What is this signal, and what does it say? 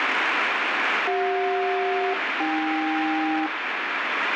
Aircraft SELCAL, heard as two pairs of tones, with heavy radio static. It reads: CJ-AK